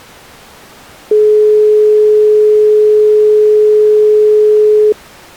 Telephone call progress tone (425 Hz plan, as in most of Europe), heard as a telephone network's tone, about 420 Hz. Dial tone.